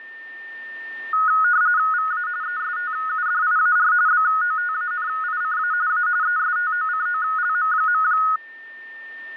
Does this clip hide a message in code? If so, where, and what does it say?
Yes: RTTY (45.45 baud, 170 Hz shift) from 1.1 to 8.4 s, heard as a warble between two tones, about 1360 Hz centre, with static crashes and a steady whistle near 1810 Hz. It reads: VA ESTUDIAR BOTANICA A ESTOCOLM.